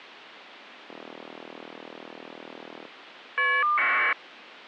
Caller ID data burst, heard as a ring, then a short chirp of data, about 1200 baud.